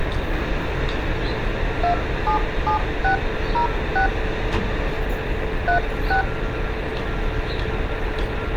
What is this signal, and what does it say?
DTMF, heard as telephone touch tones, dialled by hand, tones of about 110 ms, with phone line noise and street noise. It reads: 277606 36